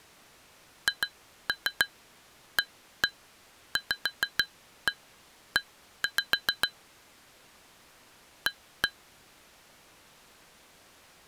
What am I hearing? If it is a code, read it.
Tap code, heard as taps on glass, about 6 knocks a second. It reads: HAVE A